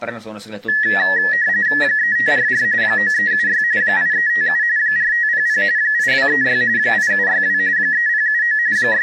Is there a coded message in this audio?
Yes: RTTY (45.45 baud, 170 Hz shift) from 0.7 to 9.0 s, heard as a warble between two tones, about 1800 Hz centre, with speech in Finnish. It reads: 3544 9376 8357 4500 8236 8762 3079 …